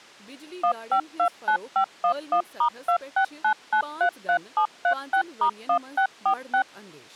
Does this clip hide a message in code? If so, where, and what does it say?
Yes: DTMF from 0.6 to 6.6 s, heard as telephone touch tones, dialled by machine, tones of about 90 ms, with speech in Kashmiri. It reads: 1529511*269933736*1646